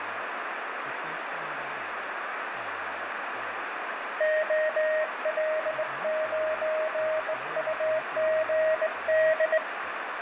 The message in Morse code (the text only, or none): OL9UGD